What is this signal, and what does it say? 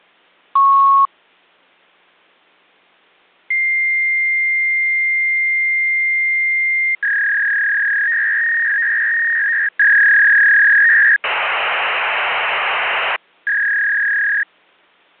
Fax machine handshake, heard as a beep, a long tone, a warble and hiss.